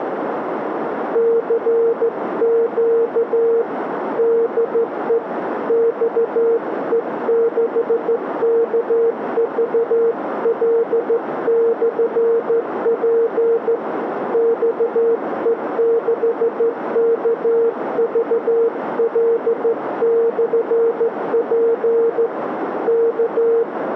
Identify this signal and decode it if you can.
Morse code, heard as a keyed tone, hand-sent with a straight key, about 14 wpm, 460 Hz, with radio static and a narrow filter. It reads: CQ DE XE6KVL/P XE6KVL/P K